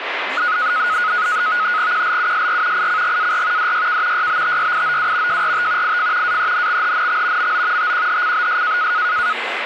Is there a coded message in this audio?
Yes: NAVTEX (SITOR-B), 100 baud, 170 Hz shift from 0.4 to 9.3 s, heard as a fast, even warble, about 1360 Hz centre, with radio static and speech in Finnish. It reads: QLUSR ICGAR DYK YBTYIOW JRT IF AENXHNX MO TQHCBS